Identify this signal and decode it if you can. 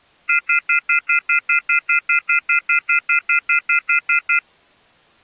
Telephone call progress tone (North American plan), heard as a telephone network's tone, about 1400, 2050, 2450, 2600 Hz, 0.1 s on and 0.1 s off. Off-hook warning tone.